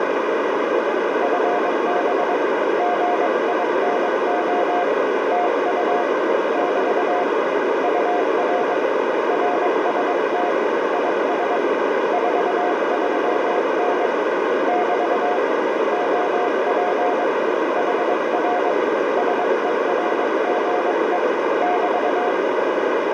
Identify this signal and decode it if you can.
Morse code, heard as a keyed tone, hand-sent with a paddle, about 22 wpm, 710 Hz, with heavy radio static and a narrow filter. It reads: FB GINO TU <BT> UR RST IS 43N <BT> OP HR SERGE <BT>